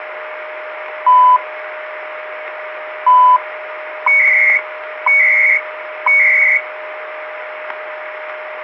Radio time signal (CHU, Canada), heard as beeps and data bursts, one a second, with radio static and a steady whistle near 620 Hz.